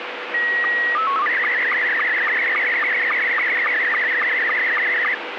SSTV (slow-scan television), Scottie S2, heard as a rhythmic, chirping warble, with radio static.